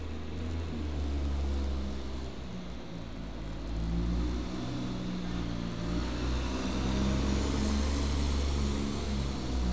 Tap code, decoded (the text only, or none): none